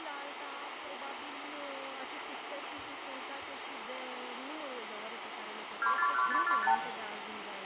Multi-frequency trunk signalling (R2, with the far end's replies), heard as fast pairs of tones, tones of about 80 ms, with phone line noise and room echo. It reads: 241545